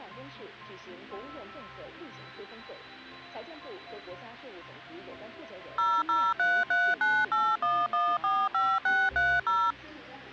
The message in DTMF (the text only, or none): 0033981145630